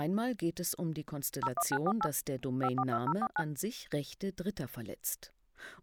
DTMF, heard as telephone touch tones, dialled by machine, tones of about 60 ms. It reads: 01948 542049